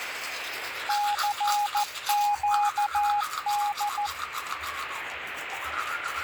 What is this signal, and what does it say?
Morse code, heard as a keyed tone, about 14 wpm, 830 Hz, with radio static and the noise of a restroom. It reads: CQD